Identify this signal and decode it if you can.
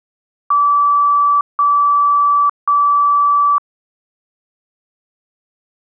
Beep code, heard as beeps, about 1160 Hz. 3 long. In IBM BIOS tables: keyboard card error.